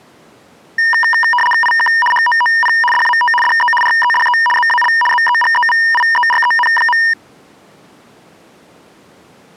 RTTY (75 baud, 850 Hz shift), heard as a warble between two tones, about 1400 Hz centre. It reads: IK HOOP DAT DE REDE ZAL ZEGEVIEREN.